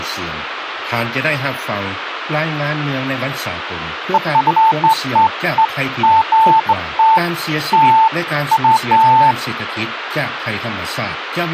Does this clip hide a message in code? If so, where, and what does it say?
No, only beeps of irregular length, with phone line noise.